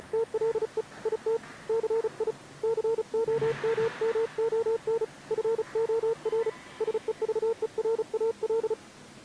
Morse code, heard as a keyed tone, hand-sent with a paddle, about 35 wpm, 460 Hz, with the noise of a subway station. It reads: … IT CI COMMON FOR SEVERAL